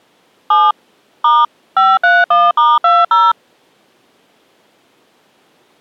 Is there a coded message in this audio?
Yes: DTMF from 0.5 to 3.3 s, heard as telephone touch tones, dialled by machine, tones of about 210 ms. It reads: 7 * 531*20